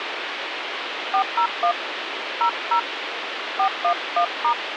DTMF, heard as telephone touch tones, dialled by hand, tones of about 90 ms, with radio hiss. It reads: 401 00 411*